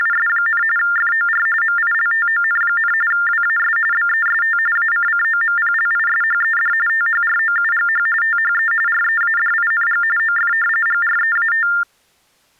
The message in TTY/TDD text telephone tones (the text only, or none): … FOR MILTON, WAS BEST ACCOMPLISHED THROUGH THE READING OF GREAT